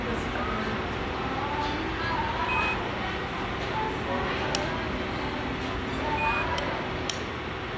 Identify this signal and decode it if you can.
Quindar tones, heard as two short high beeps, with radio hiss and the noise of a restaurant.